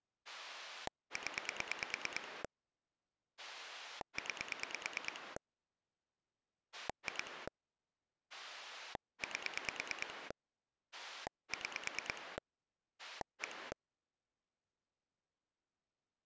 Pulse dialling, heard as a rotary dial, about 9 pulses a second. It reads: 0 9 2 8 6 1